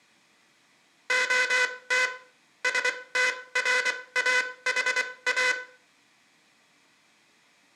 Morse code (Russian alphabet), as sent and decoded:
--- - / ... - .-. .- .... .-
ОТ СТРАХА

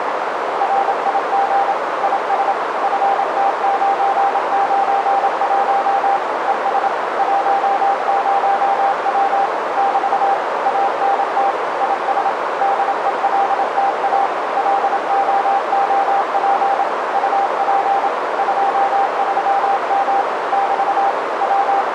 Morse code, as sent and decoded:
.-. .. --. / .. ... / ..-. - ----. ----. .---- / . ... / .---- ----- .-- / -...- / .- -. - / .. ... / -.. . .-.. - .- / .-.. --- --- .--. / ..- .--. / ..--- ...-- -- / -...- / …
RIG IS FT991 ES 10W <BT> ANT IS DELTA LOOP UP 23M <BT> …

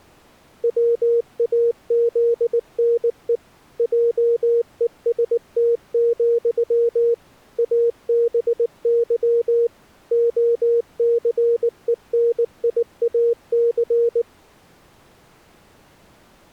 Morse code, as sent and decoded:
.-- .- --.. -. . / .--- . ... - --..-- / .- -... -.-- / --- -.-. . -. .. .- -.-.
WAZNE JEST, ABY OCENIAC

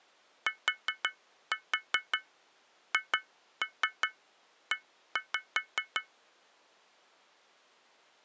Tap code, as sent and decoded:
4-4 2-3 1-5
THE

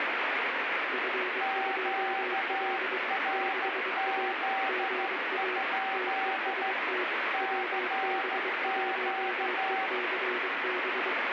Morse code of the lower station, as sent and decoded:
..-. ..--- .-.. / -.... .- / --. .- / - . ... - / .-- -... .---- . -.-. -...
F2L 6A GA TEST WB1ECB

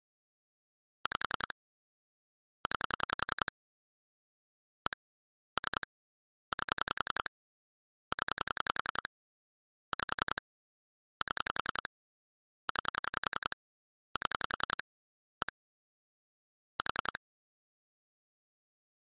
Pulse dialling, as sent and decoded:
5 / 9 / 1 / 3 / 8 / 10 / 5 / 7 / 9 / 7 / 1 / 4
5 9 1 3 8 0 5 7 9 7 1 4

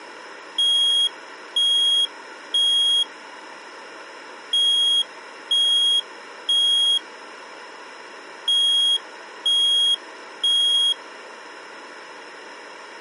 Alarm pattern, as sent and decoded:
3 beeps and a pause
temporal three

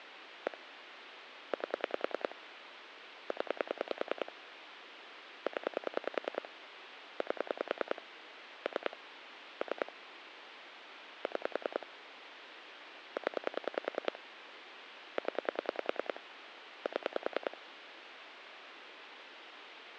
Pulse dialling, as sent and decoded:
1 / 8 / 10 / 10 / 8 / 3 / 3 / 6 / 10 / 10 / 7
1 8 0 0 8 3 3 6 0 0 7

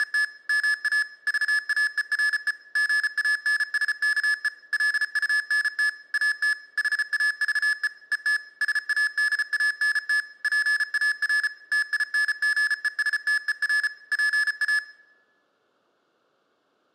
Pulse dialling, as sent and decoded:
none

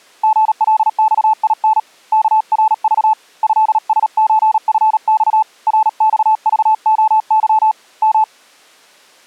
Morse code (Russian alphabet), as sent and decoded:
--. .-.. -..- .. -. / -.- .-. ...- / ..-.. ... ---. ..-. -..- / .-. -..- ...- --- -.-- / --
ГЛЬИН КРЖ ЭСЧФЬ РЬЖОЫ М

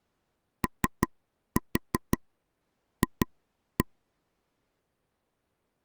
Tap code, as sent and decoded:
3-4 2-1
OF

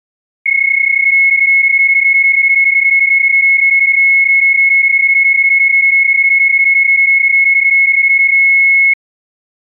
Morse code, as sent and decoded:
none

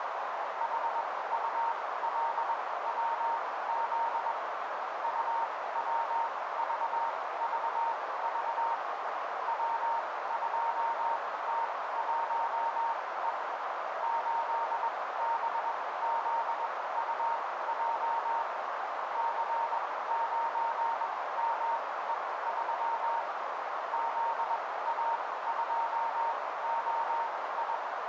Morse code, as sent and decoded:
.... ..- .-.. .-- --.. / ..- .-- ...- ...- ...- / .-- ..--- - .---- . / ---.. -... --.. ..- .--- / -.-. ----. -- . ...-- / --.. .- ..--- --- ..
HULWZ UWVVV W2T1E 8BZUJ C9ME3 ZA2OI

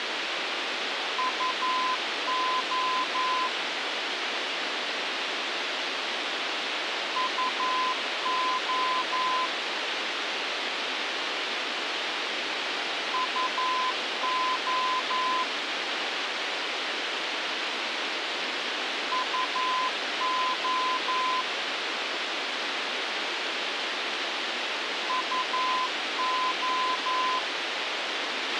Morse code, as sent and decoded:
..- --- / ..- --- / ..- --- / ..- --- / ..- ---
UO UO UO UO UO

